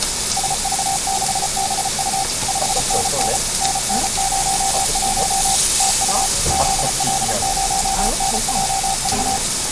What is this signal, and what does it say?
Morse code, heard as a keyed tone, machine-sent, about 34 wpm, 780 Hz, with radio static, a steady whistle near 2250 Hz and the noise of a restaurant. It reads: SV6BU 5NN NN01 TU ZL0NJV